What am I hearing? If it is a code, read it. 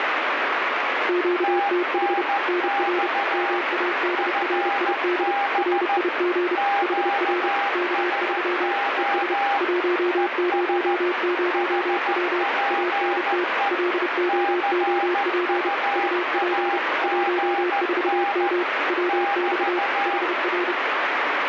Morse code, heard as two keyed tones, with heavy radio static. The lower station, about 31 wpm, 350 Hz: QTH NR MADRID RIG HR K3 ES 100W ANT LOOP UP 14M WX HR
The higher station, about 14 wpm, 800 Hz: TNX FB QSO ES HPE CUAGN <BT>